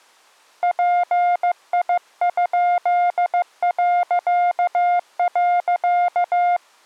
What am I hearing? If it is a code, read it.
Morse code, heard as a keyed tone, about 15 wpm, 710 Hz. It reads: PI?..